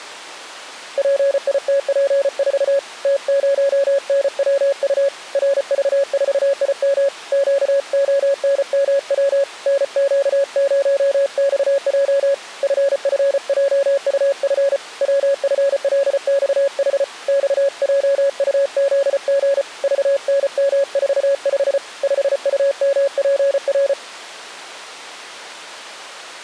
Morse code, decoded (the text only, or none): PITP4 T0NWU RV4IM QONMW NQ0XJ FFJUF WFLXH XJUZG VNM45 5UMPR